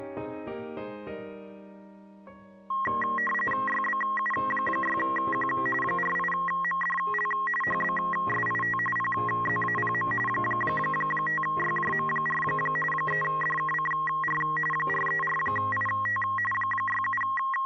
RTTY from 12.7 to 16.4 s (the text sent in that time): 3DKCR 434IT